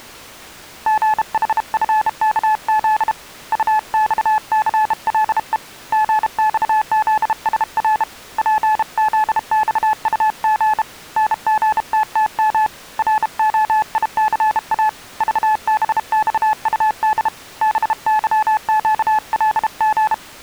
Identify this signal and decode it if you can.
Morse code, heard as a keyed tone, hand-sent with a bug key, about 32 wpm, 860 Hz. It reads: GHFKZ UXCLE GXZSR PZXUG NGTTM ROICA VBXUD BYQLG